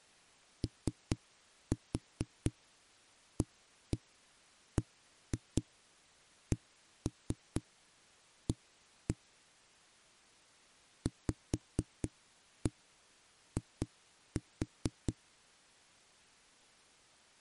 Tap code, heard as knocks on a wall, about 4 knocks a second. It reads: OABCA VI